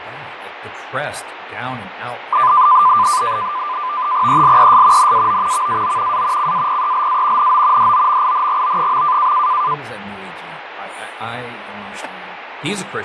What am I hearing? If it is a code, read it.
NAVTEX (SITOR-B), 100 baud, 170 Hz shift, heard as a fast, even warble, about 1100 Hz centre, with radio static, fading and speech in English. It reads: ELES NAO VAO A CAPELA NO DOMINGO.